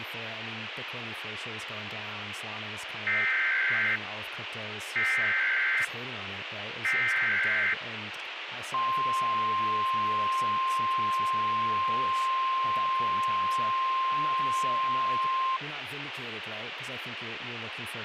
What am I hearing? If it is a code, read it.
Emergency Alert System (SAME) tones (header bursts, then the 1050 Hz attention tone), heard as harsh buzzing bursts, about 520.83 baud, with radio hiss.